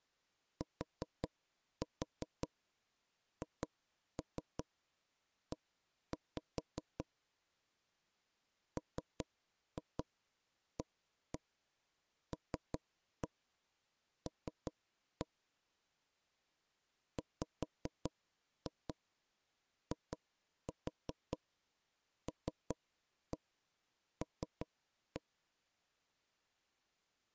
Tap code, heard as knocks on wood, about 5 knocks a second. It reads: THE MALL WILL